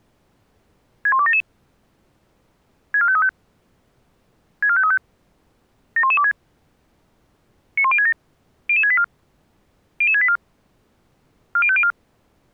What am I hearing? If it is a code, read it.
Five-tone selective call (ZVEI), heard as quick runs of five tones, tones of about 70 ms. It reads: 61277 64535 64535 71126 91067 00684 00684 40504